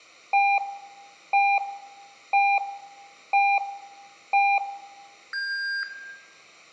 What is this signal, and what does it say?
Radio time signal (five pips and a higher one, as on Chinese radio), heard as pips, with room echo.